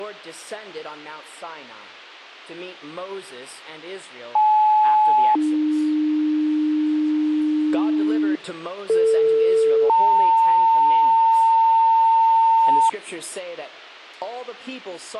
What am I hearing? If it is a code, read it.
Two-tone page, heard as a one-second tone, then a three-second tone, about 860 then 300 Hz, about 450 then 900 Hz.